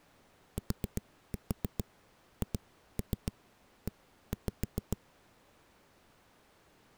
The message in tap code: THE

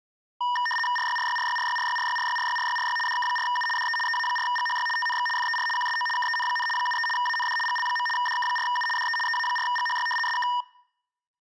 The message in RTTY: RYRYRYRYRYRYRYRYRYRY DK4U DE EA4GHY TNX FER QSO KEN, 73 AND GL. DK4U DE EA4GHY SK

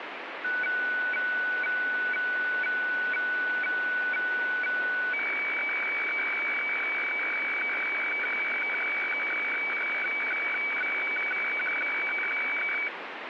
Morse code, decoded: none

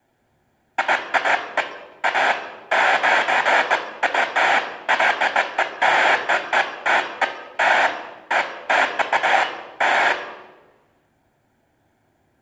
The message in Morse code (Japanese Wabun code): none

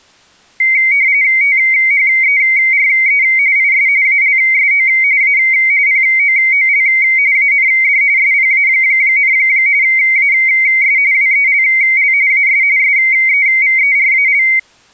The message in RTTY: THERE IS ALSO A POOL AND SPA, AS WELL AS SEVERAL

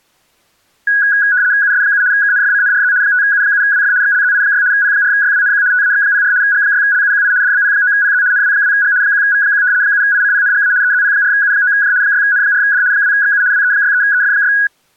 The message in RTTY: US7 KNFCNRZ 5U7WF XLZI6 P4YWNQ TAX04 G6LUQI DBP9PZ NW2G 1V1 7ICPNGA EZP4U9J 6N4D 2XU WE63EF6

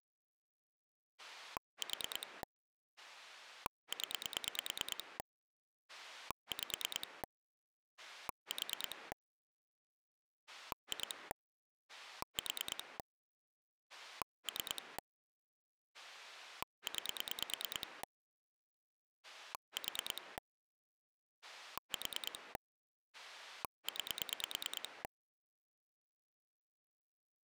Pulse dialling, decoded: 4 0 5 4 2 4 3 9 4 4 9

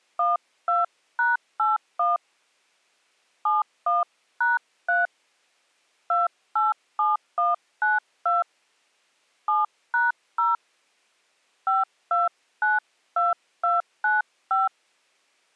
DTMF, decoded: 12#81 71#3 287192 7#0 5292295

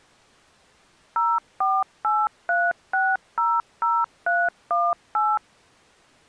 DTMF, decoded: 0483600318

